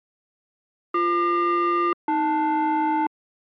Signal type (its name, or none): aircraft SELCAL